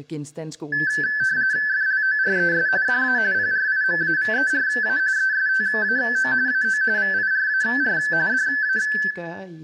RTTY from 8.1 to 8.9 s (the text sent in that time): DA